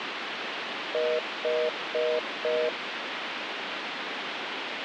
Telephone call progress tone (North American plan), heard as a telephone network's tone, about 480, 620 Hz, 0.25 s on and 0.25 s off, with phone line noise. Congestion tone.